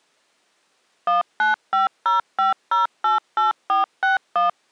DTMF, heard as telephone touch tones, dialled by machine, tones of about 140 ms. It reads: 19505088461